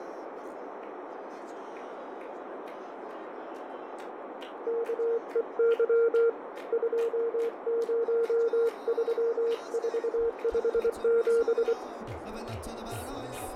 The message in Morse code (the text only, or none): KEY 203457